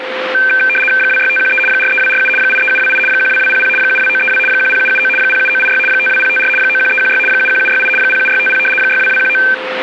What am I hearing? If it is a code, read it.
RTTY (75 baud, 850 Hz shift), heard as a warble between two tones, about 1950 Hz centre, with radio static, a steady whistle near 520 Hz and street noise. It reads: 26513 43247 83728 12200 72932 10779 07986 52054 91316 71768 07650 62219